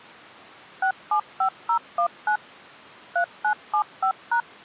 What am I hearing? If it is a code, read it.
DTMF, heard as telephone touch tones, dialled by machine, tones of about 90 ms. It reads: 675019 3975#